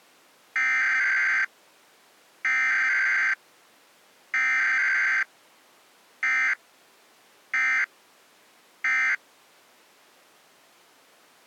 Emergency Alert System (SAME) tones (header bursts, then end-of-message bursts), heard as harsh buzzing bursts, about 520.83 baud.